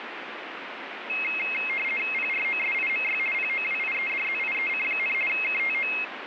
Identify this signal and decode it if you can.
RTTY (50 baud, 450 Hz shift), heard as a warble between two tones, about 2350 Hz centre, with radio static. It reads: PROSIMY POWIEDZIEC, KTO